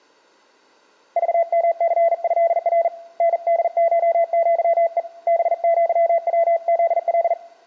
Morse code (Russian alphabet), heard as a keyed tone, hand-sent with a bug key, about 40 wpm, 670 Hz, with room echo. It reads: ЖМЦЭР НДШЪЕ БЪВЗЛ